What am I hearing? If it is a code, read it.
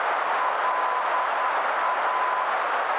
Morse code, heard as a keyed tone, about 10 wpm, 1010 Hz, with heavy radio static and a narrow filter. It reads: LA